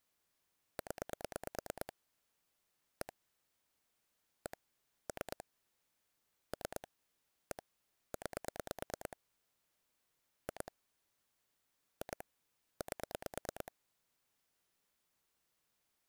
Pulse dialling, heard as clicks on a phone line, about 9 pulses a second. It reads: 0 1 1 3 3 1 9 2 2 8